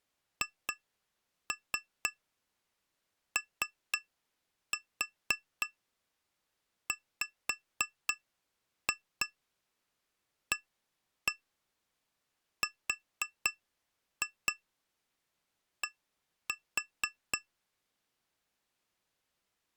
Tap code, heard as taps on glass, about 4 knocks a second. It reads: HOWARD